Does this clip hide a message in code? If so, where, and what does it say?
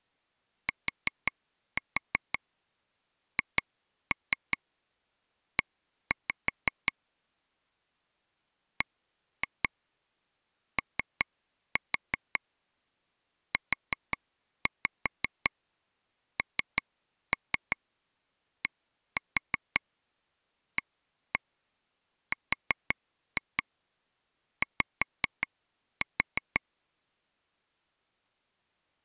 Yes: tap code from 0.7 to 26.6 s, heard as taps on a table, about 5 knocks a second. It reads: THE BOUNDARY